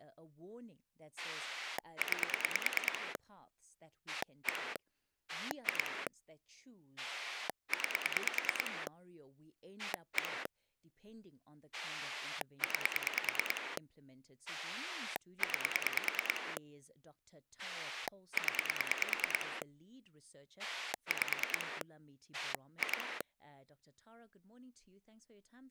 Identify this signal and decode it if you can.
Pulse dialling, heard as a rotary dial, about 9 pulses a second, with speech in English. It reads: 9 1 2 9 1 9 9 0 5 2